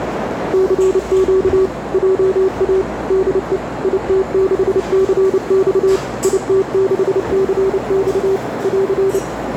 Morse code, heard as a keyed tone, machine-sent, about 29 wpm, 380 Hz, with radio static, a narrow filter and the noise of a cafe. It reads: CQ JA DE IT6CX IT6CX <AR>